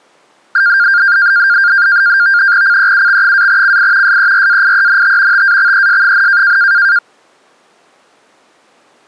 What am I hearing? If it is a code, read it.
NAVTEX (SITOR-B), 100 baud, 170 Hz shift, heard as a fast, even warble, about 1500 Hz centre. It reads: CEUX-CI SERAIENT TAXES,